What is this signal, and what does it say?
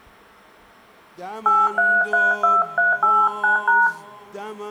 DTMF, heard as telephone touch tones, dialled by hand, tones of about 190 ms, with room echo. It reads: 8332389#